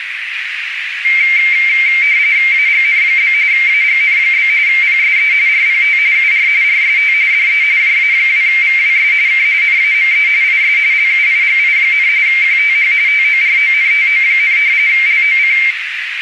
RTTY (45.45 baud, 170 Hz shift), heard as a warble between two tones, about 2200 Hz centre, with radio static and a narrow filter. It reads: AGN? AGN? PSE RPT UR RST DE JA2VWS K NAME IS LUIGI, QTH TORONTO, LOC